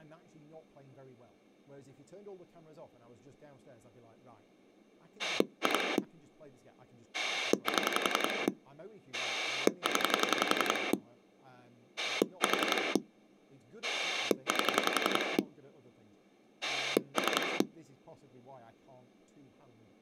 Pulse dialling, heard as a rotary dial, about 11 pulses a second, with speech in English. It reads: 2 7 0 4 8 3